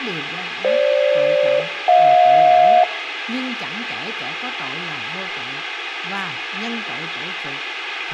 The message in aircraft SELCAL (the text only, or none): FG-HJ